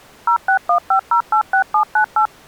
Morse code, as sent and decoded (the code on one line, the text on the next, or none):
none